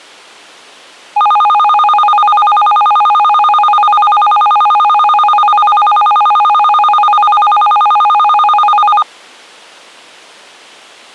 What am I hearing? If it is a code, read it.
A tone that alternates evenly between two pitches. There is no code.